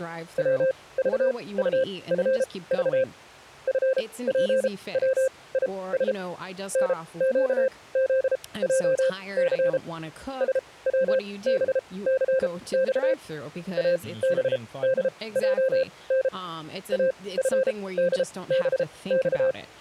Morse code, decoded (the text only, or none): WVUFV FPWIS NQZJC SWBCX ABDJN AFDBX